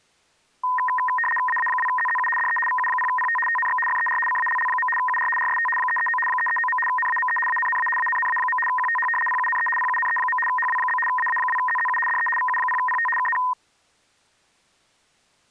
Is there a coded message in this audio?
Yes: RTTY (75 baud, 850 Hz shift) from 0.6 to 13.5 s, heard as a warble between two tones, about 1430 Hz centre. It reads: AA2ZZU DE VU0PT TNX FER CALL. UR RST 339 339. NAME ANNA ANNA. QTH PUNE PUNE. HW? AA2ZZU DE VU0PT KN